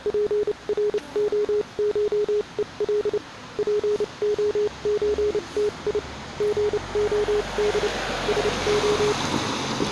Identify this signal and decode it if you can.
Morse code (Russian alphabet), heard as a keyed tone, machine-sent, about 29 wpm, spaced as for 25 wpm, 420 Hz, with the noise of a residential street. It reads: ПРОШЕЛ ПОЧТИ ГОД СО